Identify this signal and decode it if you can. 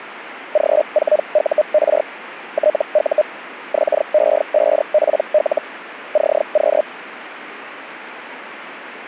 Hellschreiber (Feld-Hell, 122.5 baud), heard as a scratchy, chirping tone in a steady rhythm, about 610 Hz. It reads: G4UR TU XE5PL CQ